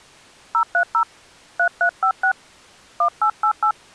DTMF, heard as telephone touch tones, dialled by hand, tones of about 80 ms. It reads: 030 3356 1888